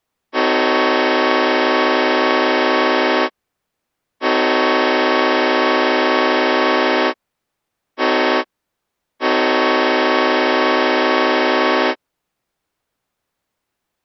Train horn signal, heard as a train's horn. 2 long, 1 short, 1 long. On North American railways: approaching a public crossing.